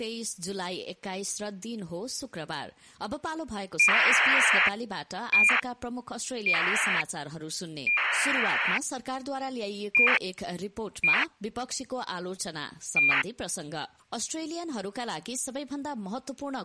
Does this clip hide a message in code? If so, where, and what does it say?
Yes: ACARS aircraft data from 3.8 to 13.2 s, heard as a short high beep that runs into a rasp, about 2400 baud.